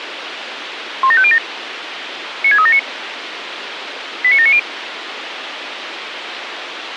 Five-tone selective call (ZVEI), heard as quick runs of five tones, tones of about 70 ms, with radio hiss. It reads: 17507 96379 89790